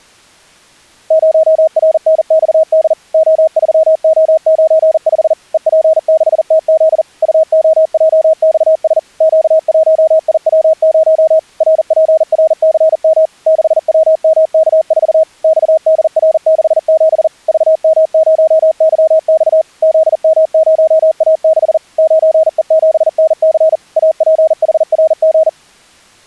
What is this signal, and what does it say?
Morse code, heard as a keyed tone, machine-sent, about 40 wpm, 640 Hz. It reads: 0RNXD O3O95 EP6TZ UOJXS Q1IW0 RPRCM 6WMK4 XDR67 VM0YX ZM0A6 9E7NC APHRG